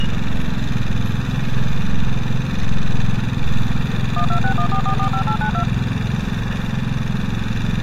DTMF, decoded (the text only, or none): 12614445892